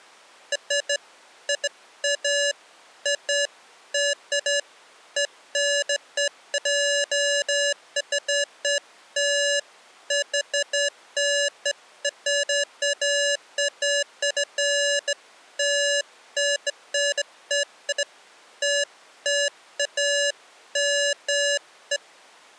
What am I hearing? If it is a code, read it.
Beeps of irregular length. There is no code.